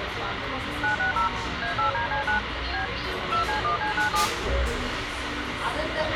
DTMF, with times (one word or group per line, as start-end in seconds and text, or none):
0.8-1.3 960
1.6-2.4 A8DC9
2.7-2.9 B
3.3-4.3 2C1C97